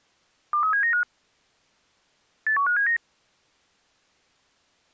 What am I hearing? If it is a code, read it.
Five-tone selective call (CCIR), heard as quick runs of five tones, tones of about 100 ms. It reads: 23795 81579